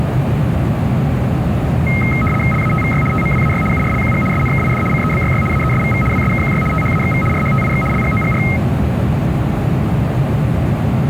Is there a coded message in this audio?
Yes: RTTY (75 baud, 850 Hz shift) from 1.9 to 8.6 s, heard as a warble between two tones, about 1700 Hz centre, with radio static and a steady whistle near 420 Hz. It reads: LATVY TMWAY URLQG SNKID CEBYY AESVV WSKQY THAXV RHTIX LGOGR